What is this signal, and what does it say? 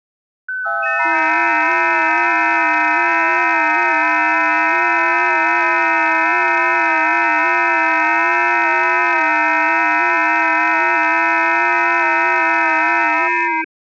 FT8 (several signals at once), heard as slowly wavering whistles, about 6.25 baud.